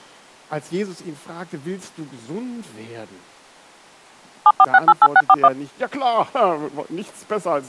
DTMF, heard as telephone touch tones, dialled by machine, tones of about 50 ms. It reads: 74688641